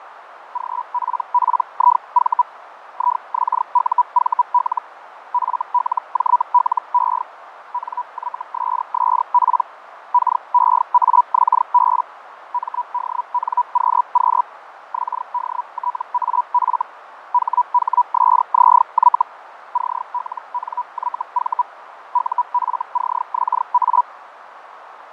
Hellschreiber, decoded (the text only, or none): GPPIV IXUVL FLJLE NYSSP KEAXB MDNQQ XDTAF HHSZY CLNYV UFCXA